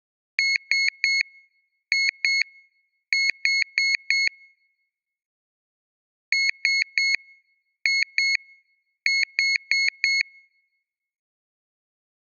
Beep code, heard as a piezo beeper, played twice, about 2200 Hz. 3-2-4. In Phoenix BIOS tables: keyboard controller failure.